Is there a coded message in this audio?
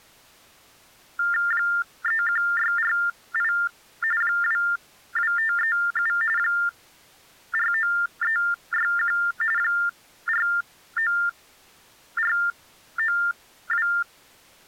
Yes: TTY/TDD text telephone tones (45.45 baud Baudot) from 1.2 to 14.0 s, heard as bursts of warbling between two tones, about 400 Hz shift, 1600 Hz centre. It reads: 31648 22537 49361 49492